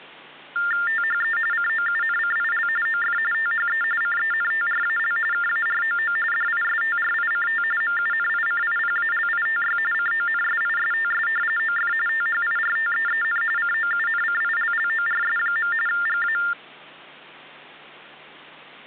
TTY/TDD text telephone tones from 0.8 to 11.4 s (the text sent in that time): THE COUNCIL OF THE CENTRAL KAROO DISTRICT MUNICIPALITY CONSISTS